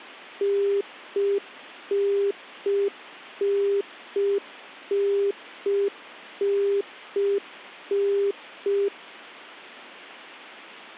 Telephone call progress tone (UK plan), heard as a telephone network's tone, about 400 Hz. Congestion tone.